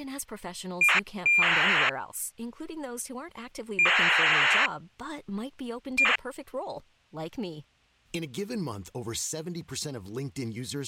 ACARS aircraft data, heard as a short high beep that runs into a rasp, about 2400 baud, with speech in French.